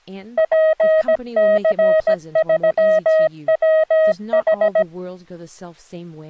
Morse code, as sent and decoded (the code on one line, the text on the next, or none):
.--. -.-. ...-- .-- ....
PC3WH